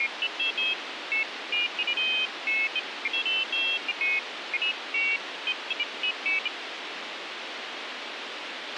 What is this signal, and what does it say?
Pairs of high tones at irregular times, with radio hiss and a squelch burst at the end. There is no code.